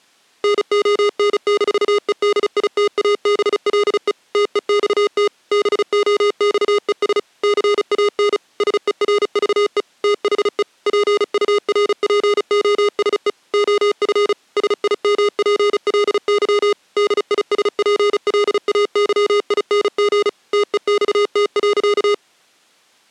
Morse code, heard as electronic beeps, machine-sent, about 35 wpm, 410 Hz. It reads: NON-EDITABLE TEXT BOXES CAN SERVE THE PURPOSE OF SIMPLY DISPLAYING TEXT.